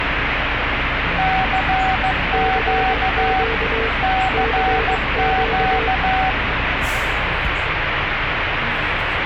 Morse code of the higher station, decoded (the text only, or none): CQ CQ